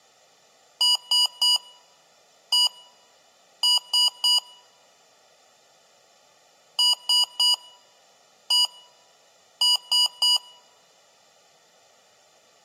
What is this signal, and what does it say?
Beep code, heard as beeps from a small speaker, played twice, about 980 Hz, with room echo. 3-1-3. In Phoenix BIOS tables: interrupt mask register failure.